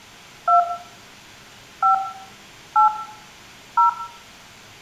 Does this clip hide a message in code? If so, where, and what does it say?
Yes: DTMF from 0.5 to 3.9 s, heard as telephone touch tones, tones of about 120 ms, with room echo. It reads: 2 5 8 0